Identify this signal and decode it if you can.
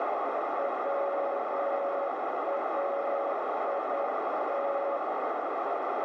Morse code, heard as a keyed tone, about 9 wpm, 560 Hz, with heavy radio static and a narrow filter. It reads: WAIT